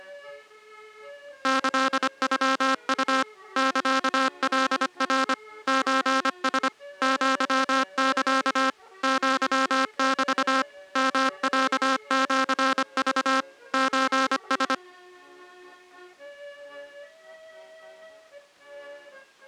Morse code (Japanese Wabun code), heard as a buzzer, machine-sent, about 25 wpm. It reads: キノウ サカナ ソラ アサ アメ ヨロシク ソラ